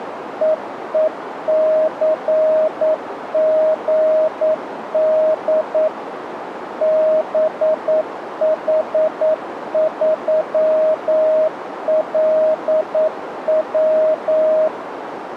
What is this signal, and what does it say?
Morse code, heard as a keyed tone, machine-sent, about 9 wpm, 630 Hz, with radio static and a narrow filter. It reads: EECGD BH3LW